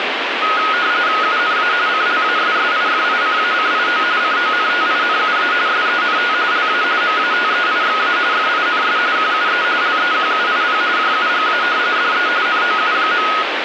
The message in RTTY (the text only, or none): UNA CLASSIFICACIO CONTINUA SENT LA MATEIXA FINS QUE LEQUIP JUGA DE NOU.